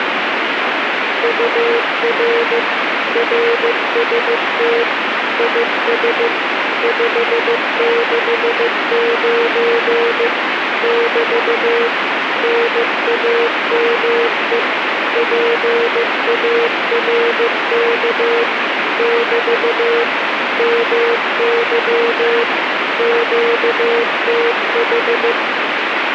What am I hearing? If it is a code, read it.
Morse code, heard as a keyed tone, machine-sent, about 15 wpm, 470 Hz, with radio static. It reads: UR RST IS 569 <BT> NAME PARK <BT> MY QTH